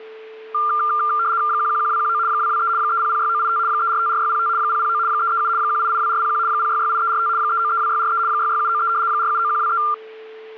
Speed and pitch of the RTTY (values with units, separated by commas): 75 baud, 170 Hz shift, 1280 Hz centre